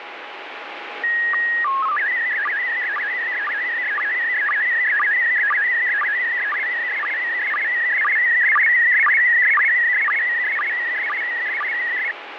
SSTV (slow-scan television), PD 120, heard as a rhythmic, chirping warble, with radio static.